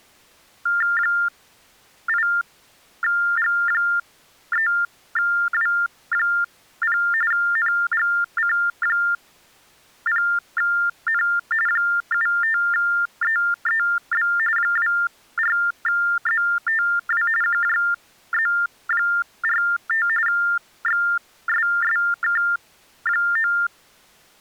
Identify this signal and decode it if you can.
TTY/TDD text telephone tones (45.45 baud Baudot), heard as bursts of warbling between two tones, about 400 Hz shift, 1600 Hz centre. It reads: 8G3W0 NGC0N 75EEB 24ZTW QJZ45 XSSK9